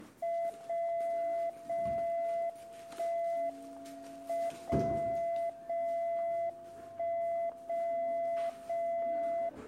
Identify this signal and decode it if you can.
Radio time signal (WWVB), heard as a tone whose level steps once a second, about 680 Hz, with static crashes and the noise of a crowd indoors. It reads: 0 0 1 M 0 0 1 0 0